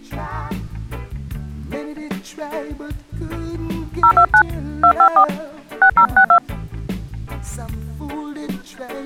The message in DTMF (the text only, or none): 029 254 6062